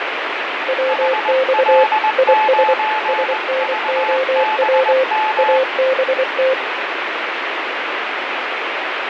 Morse code, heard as two keyed tones, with radio static and fading. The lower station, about 24 wpm, 520 Hz: WX IS SNOW ABT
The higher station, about 20 wpm, 860 Hz: HL9VBM